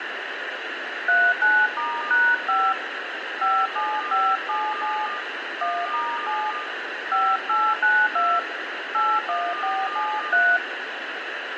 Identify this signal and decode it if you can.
DTMF, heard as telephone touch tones, dialled by hand, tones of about 240 ms, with radio hiss and room echo. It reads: 39*#5 57577 1*7 5892 81473